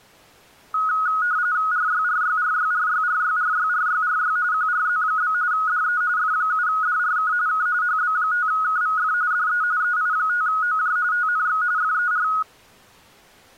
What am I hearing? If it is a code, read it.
RTTY (45.45 baud, 170 Hz shift), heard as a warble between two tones, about 1360 Hz centre. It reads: RYRYRYRYRYRYRYRY QRZ? DE F7DRK K HB5KVF DE EI5OJ TNX FER